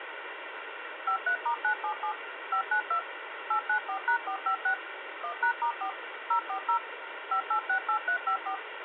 DTMF, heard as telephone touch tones, dialled by machine, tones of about 90 ms, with phone line noise. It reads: 53*977 592 894#456 1#*4 040 5868354